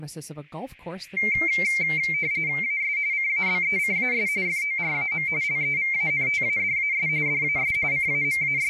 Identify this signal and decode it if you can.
RTTY (45.45 baud, 170 Hz shift), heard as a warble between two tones, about 2200 Hz centre, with speech in English. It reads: AS CABECAS FORAM LEVANTADAS DAS …